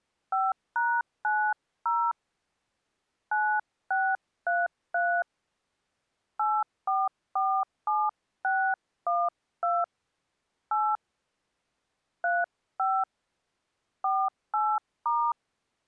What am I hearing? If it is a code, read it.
DTMF, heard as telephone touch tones, dialled by hand, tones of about 250 ms. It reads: 5#90 9633 8447612 8 35 48*